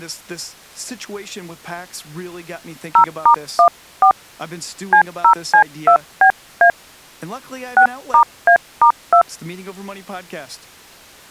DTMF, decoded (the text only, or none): 0*14 C0C2BA 6*A*2